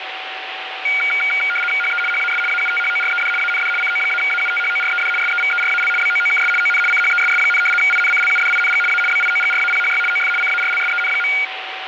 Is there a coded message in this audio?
Yes: RTTY (75 baud, 850 Hz shift) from 0.8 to 11.4 s, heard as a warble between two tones, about 1850 Hz centre, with radio static and a steady whistle near 760 Hz. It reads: HE HAS AUTHORED AND CO-AUTHORED SEVERAL BOOKS ON CHESS, INCLUDING A BIOGRAPHY OF CARLSEN.